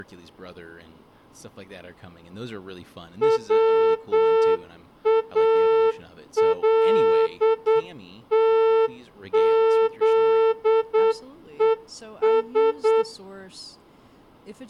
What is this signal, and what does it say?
Morse code, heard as a horn, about 8 wpm, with speech in English. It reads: WALTZES